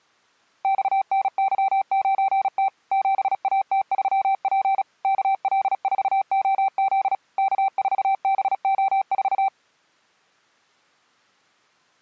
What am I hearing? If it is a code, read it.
Morse code, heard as a keyed tone, machine-sent, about 36 wpm, 780 Hz. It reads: XNY9T 7AT3P KL4OZ K4BO4